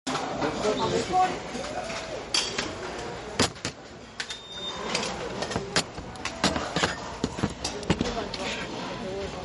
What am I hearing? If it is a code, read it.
The noise of a restaurant. There is no code.